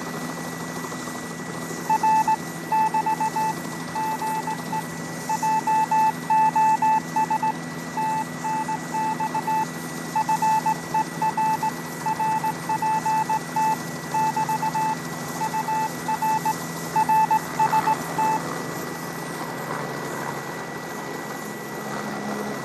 Morse code, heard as a keyed tone, hand-sent with a straight key, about 18 wpm, 880 Hz, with radio static, fading and a steady whistle near 1950 Hz. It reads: R <BT> GE JOS TNX FER RPT <BT> UR RST